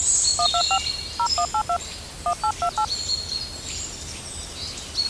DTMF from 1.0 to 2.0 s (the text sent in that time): 0182